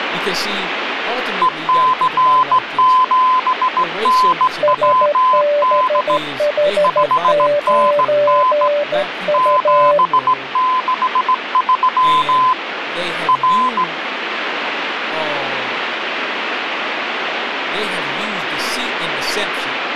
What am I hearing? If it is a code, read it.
Morse code, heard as two keyed tones, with radio static and speech in English. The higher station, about 17 wpm, 1020 Hz: EC7NWD 5NN 763 R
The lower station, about 13 wpm, 580 Hz: SBH9U